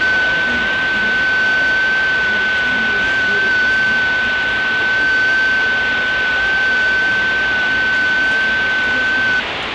FT8 (one signal), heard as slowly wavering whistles, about 6.25 baud, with radio static and the noise of a crowd indoors.